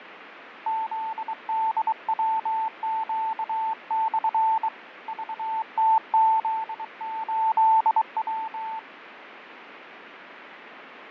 Morse code, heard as a keyed tone, hand-sent with a bug key, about 23 wpm, 890 Hz, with radio static and fading. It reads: ZDWQ/ VTZ8W